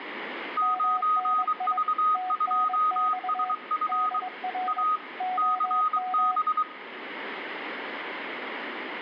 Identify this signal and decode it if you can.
Morse code, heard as two keyed tones, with radio static and room echo. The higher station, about 23 wpm, 1250 Hz: 9V2SF A CB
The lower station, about 22 wpm, 740 Hz: MNI TNX DR OM